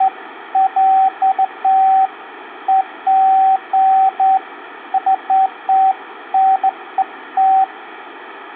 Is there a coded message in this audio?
No, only beeps of irregular length, with phone line noise.